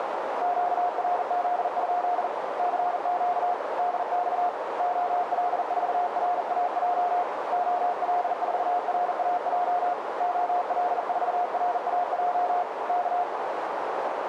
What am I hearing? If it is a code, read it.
Morse code, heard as a keyed tone, hand-sent with a bug key, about 40 wpm, 710 Hz, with heavy radio static and a narrow filter. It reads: QRZ? CQ DX OL4RAJ OL4RAJ OL4RAJ K